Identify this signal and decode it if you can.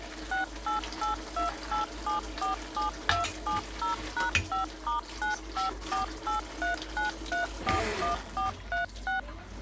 DTMF, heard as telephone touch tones, dialled by machine, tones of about 130 ms, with kitchen noise. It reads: 68828747270#5*954839341436